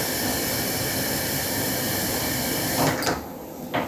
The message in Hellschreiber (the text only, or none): none